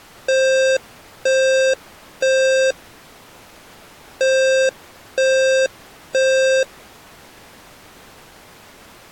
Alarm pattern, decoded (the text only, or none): temporal three